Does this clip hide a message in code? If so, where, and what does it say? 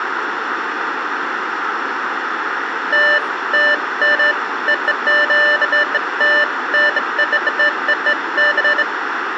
No, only beeps of irregular length, with phone line noise, room echo and speech in English.